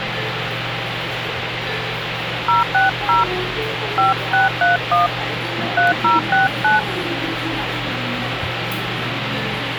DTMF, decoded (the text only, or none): 060 5631 3069